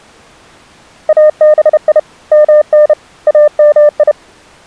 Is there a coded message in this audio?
Yes: Morse code (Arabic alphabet) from 1.0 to 4.2 s, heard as a keyed tone, hand-sent with a paddle, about 31 wpm, 600 Hz. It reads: ابي من امي